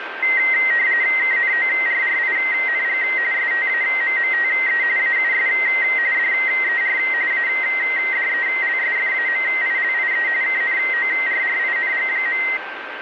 RTTY (45.45 baud, 170 Hz shift), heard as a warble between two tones, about 2000 Hz centre, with radio static and a steady whistle near 1560 Hz. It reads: KNORRING STAMMTE AUS DER ADELSFAMILIE KNORRING.